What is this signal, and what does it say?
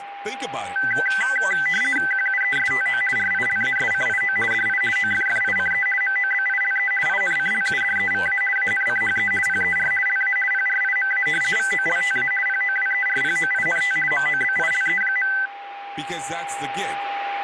RTTY (50 baud, 450 Hz shift), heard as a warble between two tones, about 1750 Hz centre, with radio static, a steady whistle near 800 Hz and speech in English. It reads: QUESTO RILASCIO DI OFFICE MOBILE INCLUDEVA ANCHE PER LA PRIMA VOLTA POWERPOINT MOBILE.